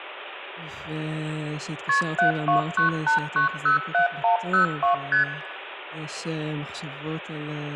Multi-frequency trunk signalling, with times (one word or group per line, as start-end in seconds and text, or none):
1.9-2.0 KP
2.2-4.9 7298907102
5.1-5.2 ST